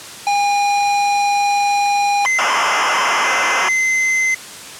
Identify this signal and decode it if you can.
ZX Spectrum tape loading, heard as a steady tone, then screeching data.